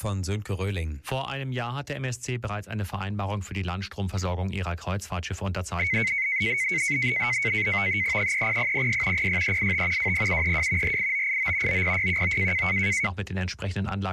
NAVTEX (SITOR-B), 100 baud, 170 Hz shift, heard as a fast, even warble, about 2150 Hz centre. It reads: 30006 06385 20732 48989 90619